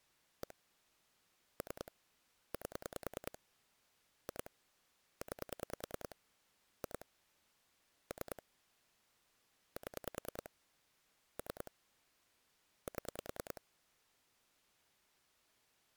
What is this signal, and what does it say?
Pulse dialling, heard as clicks on a phone line, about 10 pulses a second. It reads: 1 3 8 2 9 2 3 7 3 7